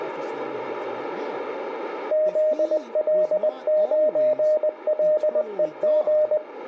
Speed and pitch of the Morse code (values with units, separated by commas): 20 wpm, 610 Hz